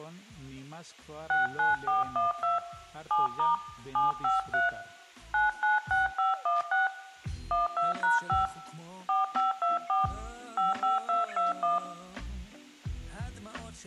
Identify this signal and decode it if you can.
DTMF, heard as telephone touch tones, dialled by hand, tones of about 160 ms, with room echo. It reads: 69412 7* 753 996516 12#5 4524 55221